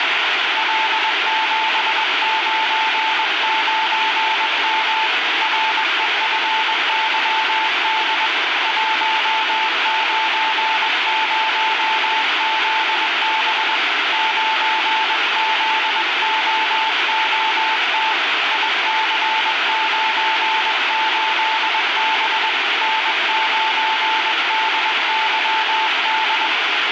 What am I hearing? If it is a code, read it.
Morse code, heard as a keyed tone, hand-sent with a paddle, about 21 wpm, 880 Hz, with heavy radio static. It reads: L799M REFYD 190ZB 9ZOOT IC98B N9DYD